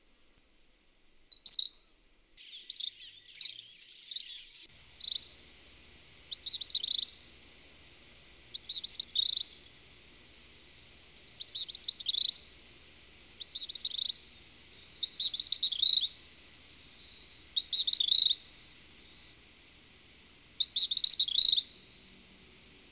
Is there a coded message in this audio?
No.